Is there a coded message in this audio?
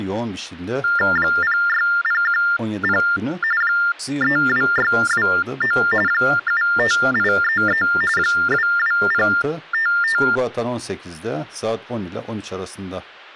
Yes: TTY/TDD text telephone tones (45.45 baud Baudot) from 0.8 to 10.4 s, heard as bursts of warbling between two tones, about 400 Hz shift, 1600 Hz centre. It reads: 06010 32629 75833 22055